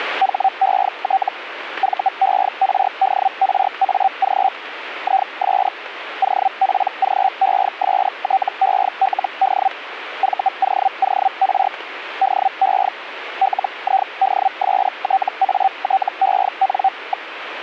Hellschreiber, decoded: HET VERDRAG IS OPGESTELD VOOR DE LIDSTATEN.

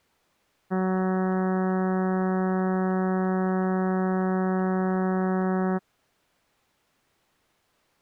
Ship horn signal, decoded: 1 long

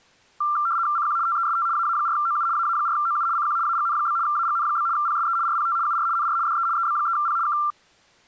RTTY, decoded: CQ TEST AA4OU AA4OU CQ AGN? AGN? PSE RPT UR NR DE EB3P K

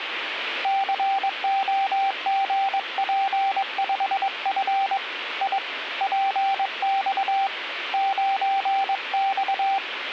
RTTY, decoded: none

